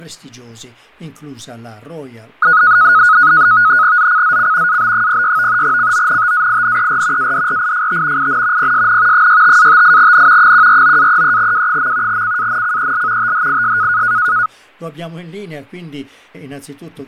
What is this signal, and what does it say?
NAVTEX (SITOR-B), 100 baud, 170 Hz shift, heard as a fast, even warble, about 1360 Hz centre, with fading. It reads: ZCZC AB06 CONTAINER ADRIFT IN PSN 65-58N 149-33W. CANCEL THIS